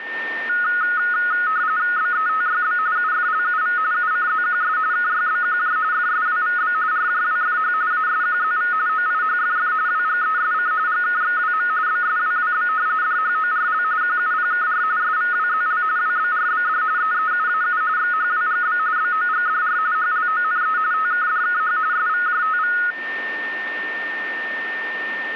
RTTY (45.45 baud, 170 Hz shift), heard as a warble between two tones, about 1360 Hz centre, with a steady whistle near 1810 Hz. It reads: BETYB UFLUV UCZQS KYBQJ FSWVB RJWFH ASQZV OIHFF WGESC GKXWM BSWWB DHORL QUPKR SVWZL WBRBD EEUAU XHWGB BOGDR HLONE TKDKH SVJTV